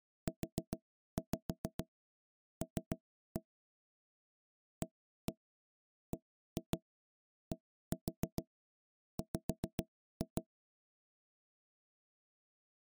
Tap code, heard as knocks on wood, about 7 knocks a second. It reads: UL ABDW